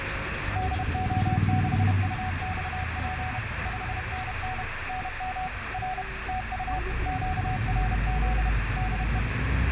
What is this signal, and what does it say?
Morse code, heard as a keyed tone, machine-sent, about 31 wpm, 740 Hz, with radio static and the noise inside a bus. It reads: DO6UXP 5NN NM R TU QRZ DE